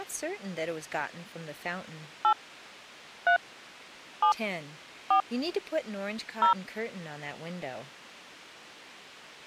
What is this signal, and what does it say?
DTMF, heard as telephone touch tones, dialled by hand, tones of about 100 ms. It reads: 8 3 7 4 0